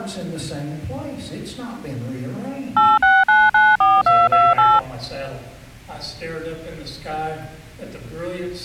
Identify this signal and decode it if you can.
DTMF, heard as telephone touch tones, dialled by machine, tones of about 210 ms. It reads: 86994228